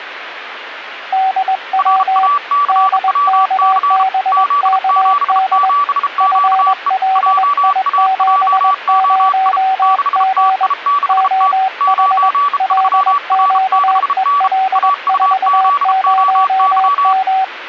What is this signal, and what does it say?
Morse code, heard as two keyed tones, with radio static. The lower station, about 21 wpm, 760 Hz: DW DKBKD FLI70G OH LQEL40M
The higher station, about 33 wpm, 1150 Hz: RACWC Z77QE JAJOI 6TI6T 93R6N AUZOY